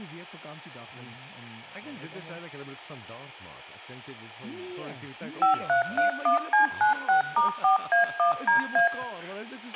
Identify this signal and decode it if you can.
DTMF, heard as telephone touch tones, dialled by machine, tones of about 120 ms, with a squelch burst at the end and room echo. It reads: 5331C96*4A1DA